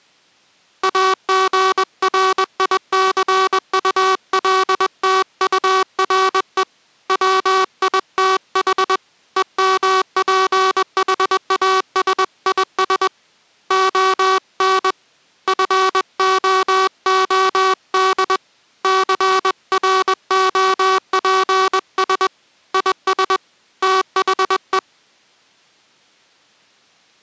Morse code, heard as a buzzer, hand-sent with a paddle, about 21 wpm. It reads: AGRICULTURE WITH EMPHASIS ON FOOD CROPS IS THE